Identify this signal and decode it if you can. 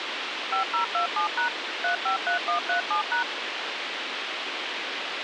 DTMF, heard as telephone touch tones, dialled by machine, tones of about 110 ms, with radio hiss. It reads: 5027# 353137#